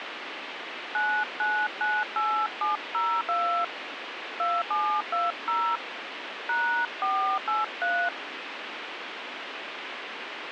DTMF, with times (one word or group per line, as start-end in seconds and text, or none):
0.9-3.6 9998702
4.4-5.8 2720
6.5-8.1 #483